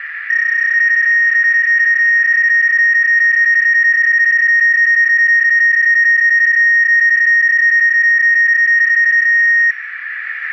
PSK31 (31.25 baud), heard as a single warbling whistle, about 1850 Hz, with radio static and a narrow filter.